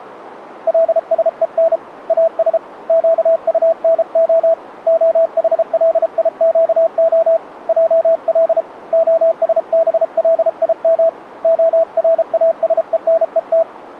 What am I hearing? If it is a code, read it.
Morse code (Hebrew alphabet), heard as a keyed tone, hand-sent with a paddle, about 33 wpm, 660 Hz. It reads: לשון אש קטנה החליקה על השבלים הראשונות